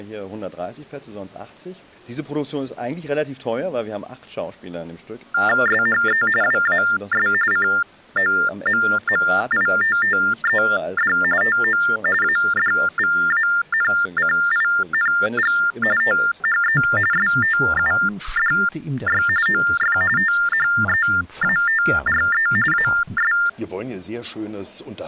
TTY/TDD text telephone tones (45.45 baud Baudot), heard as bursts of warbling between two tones, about 400 Hz shift, 1600 Hz centre. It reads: SHE WAS COMMITTED TO ADVANCING THE STUDY OF THEATRE AS